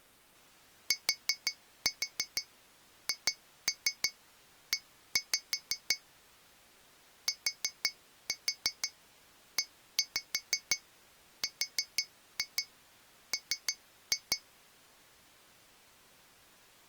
Tap code, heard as taps on glass, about 5 knocks a second. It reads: THE TERM